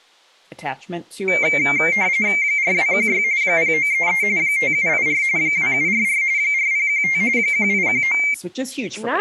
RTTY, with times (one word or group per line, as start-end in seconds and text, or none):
2.4-3.2 4216
3.4-4.2 0933
4.4-5.2 5784
5.4-6.2 2744
6.4-7.2 4015
7.4-8.2 1819